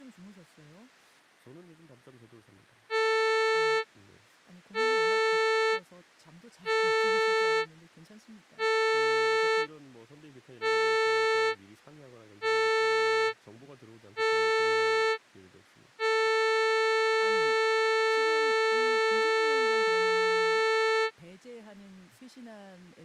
Ship horn signal, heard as a ship's horn, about 440 Hz, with speech in Korean. 7 short, 1 long. At sea: general emergency alarm.